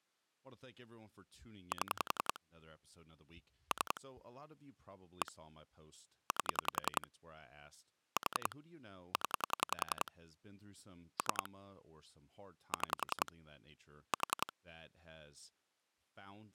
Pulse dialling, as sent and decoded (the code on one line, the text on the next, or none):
7 / 3 / 1 / 8 / 4 / 10 / 3 / 6 / 4
7 3 1 8 4 0 3 6 4